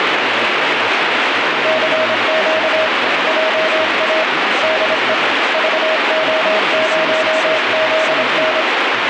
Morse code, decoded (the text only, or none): CQ JA DE VO0ZN